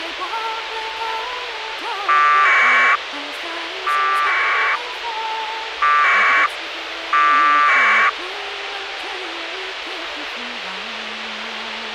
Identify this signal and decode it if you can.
Packet radio (AX.25, as in APRS), 1200 baud, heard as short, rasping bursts, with radio hiss.